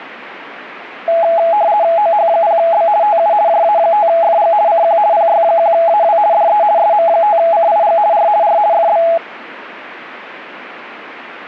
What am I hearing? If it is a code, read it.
RTTY (50 baud, 170 Hz shift), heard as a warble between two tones, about 750 Hz centre, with radio static. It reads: OH0B TU JA5FG CQ PY1AW DE SM5CIG R R FB